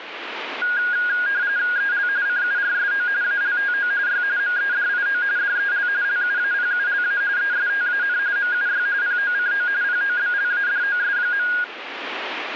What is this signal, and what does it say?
RTTY (45.45 baud, 170 Hz shift), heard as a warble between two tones, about 1550 Hz centre, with radio static. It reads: EL CURSO ALTO Y MEDIO DEL LUAPULA ESTAN MUY POCO POBLADOS.